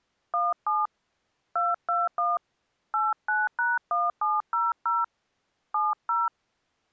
DTMF, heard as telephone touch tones, dialled by hand, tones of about 190 ms. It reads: 17 221 89#1700 70